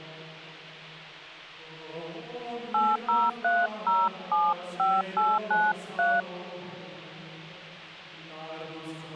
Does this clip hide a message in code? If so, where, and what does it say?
Yes: DTMF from 2.7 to 6.2 s, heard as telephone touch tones, dialled by hand, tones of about 220 ms. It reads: 803075893